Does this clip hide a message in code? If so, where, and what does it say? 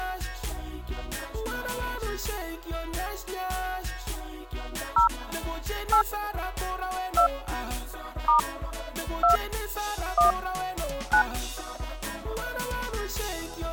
Yes: DTMF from 5.0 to 11.2 s, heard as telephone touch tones, dialled by hand, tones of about 100 ms. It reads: 0 8 2 * 2 1 9